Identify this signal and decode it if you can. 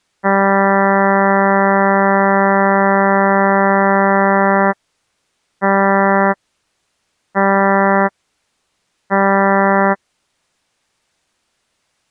Ship horn signal, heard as a ship's horn, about 200 Hz. 1 long, 3 short. At sea: a vessel under tow in fog.